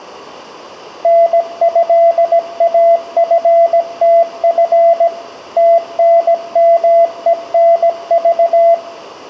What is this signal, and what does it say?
Morse code (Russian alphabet), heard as a keyed tone, machine-sent, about 17 wpm, 680 Hz, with room echo. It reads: НЭАФТФ ТНМЕНЖ